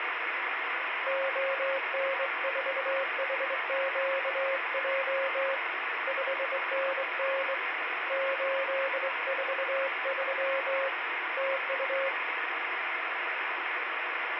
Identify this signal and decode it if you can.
Morse code, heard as a keyed tone, hand-sent with a straight key, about 23 wpm, 540 Hz, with radio static. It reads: ON4HQJ 5NN 843 TU